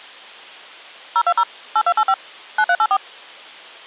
DTMF, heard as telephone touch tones, dialled by machine, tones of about 60 ms. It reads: 020 8285 9384